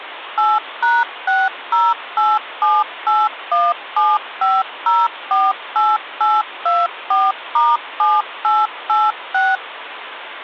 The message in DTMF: 8#60878175048824*7886

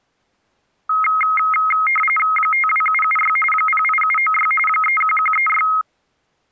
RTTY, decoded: 52776 08796 31136

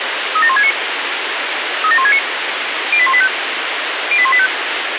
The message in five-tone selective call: 37169 37169 08185 08185

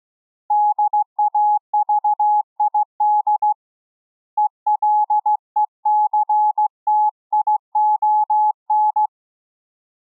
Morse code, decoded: DAVID ELECTION

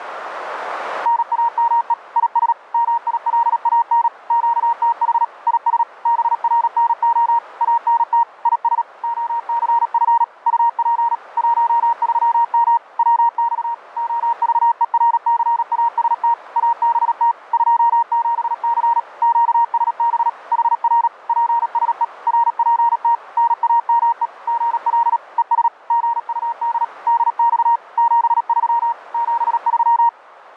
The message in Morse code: NAME IS MILAN QTH IS BRNO ANT IS OCF UP 13M WX OVERCAST ABT 27C QSB HR PSE RPT NAME GL ES GUD DX 73 73

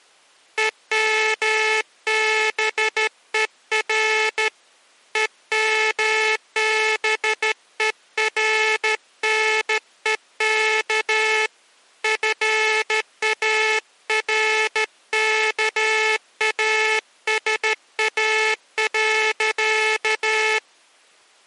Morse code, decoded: EMBER EMBERNEK FARKASA.

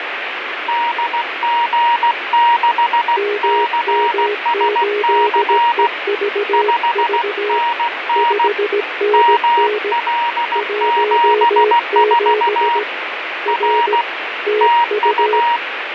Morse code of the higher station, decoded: DG6CSC 5NN ML74 R TU

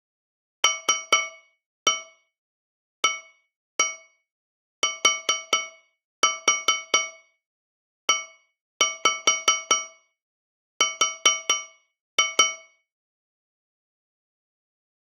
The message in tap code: LATER

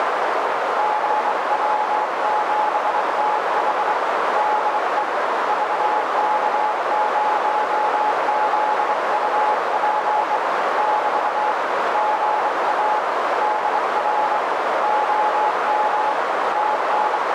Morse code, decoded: GW7TH DE VK0ZUP <BT> GA DR OM …

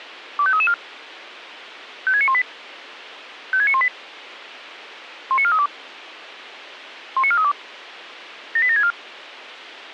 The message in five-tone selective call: 25334 56918 56918 19432 19432 78764

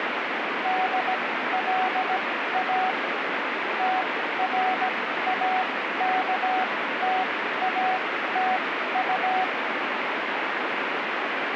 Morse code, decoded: DLA TRAKTATU

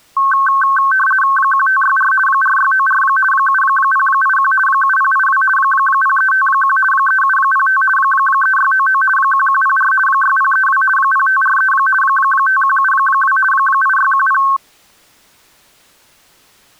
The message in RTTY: 1564 4694 7081 7082 0351 3705 3699 1104 6032 0543 5172 8610

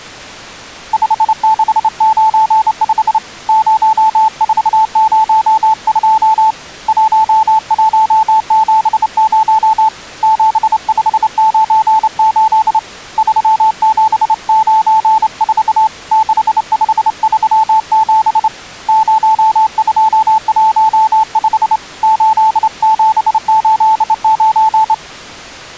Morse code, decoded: 5695 0402 1170 7598 3794 6537 0215 8789

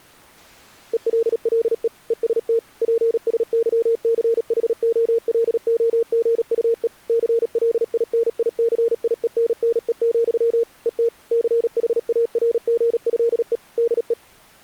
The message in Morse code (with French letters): ELLE EST PSYCHOLOGUE CLINICIENNE, ET CHARGÉE DE

